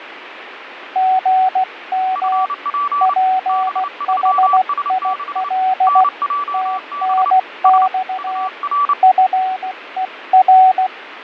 Morse code, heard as two keyed tones, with radio static and fading. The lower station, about 16 wpm, 750 Hz: GM PHIL TNX FER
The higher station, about 29 wpm, 1150 Hz: FP B3S6 NJB S UR